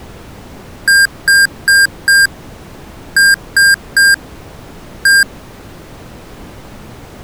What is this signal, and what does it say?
Beep code, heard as beeps from a small speaker, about 1600 Hz. 4-3-1. In Phoenix BIOS tables: memory failure above the first 64 KB.